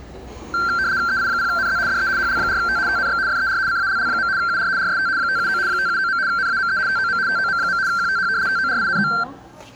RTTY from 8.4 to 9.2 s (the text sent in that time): TORINO